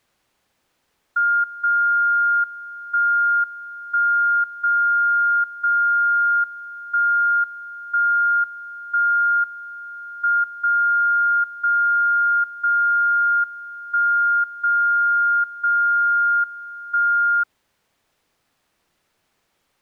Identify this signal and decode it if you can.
Radio time signal (WWVB), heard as a tone whose level steps once a second, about 1410 Hz. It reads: 0 1 1 0 0 1 1 1 M 0 0 0 1 0 0 1